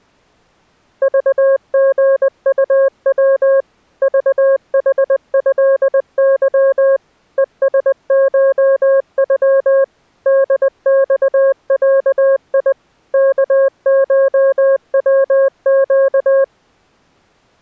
Morse code (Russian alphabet), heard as a keyed tone, machine-sent, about 20 wpm, 540 Hz. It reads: ЖГУВ ЖХЭЫ ЕСШЮ ДЬЯИ КШВЩ